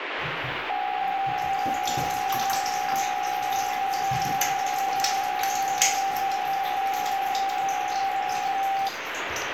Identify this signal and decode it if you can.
PSK63 (62.5 baud), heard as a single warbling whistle, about 780 Hz, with radio static and the noise of a restroom.